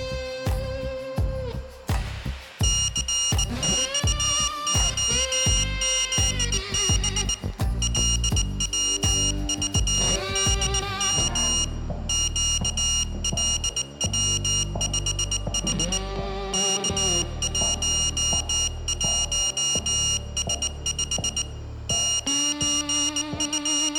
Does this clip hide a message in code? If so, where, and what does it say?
Yes: Morse code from 2.6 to 24.0 s, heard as a high beeper, hand-sent with a bug key, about 19 wpm, 2850 Hz, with room echo. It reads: CXOZB LWVDM QLW5H K11S5 …